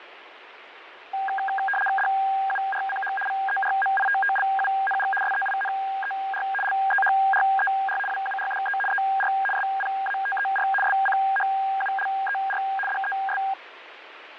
RTTY (75 baud, 850 Hz shift), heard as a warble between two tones, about 1200 Hz centre, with radio static and fading. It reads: DURCH VERMITTLUNG SEINER LEHRER WURDE ER SPATER SCHULER DES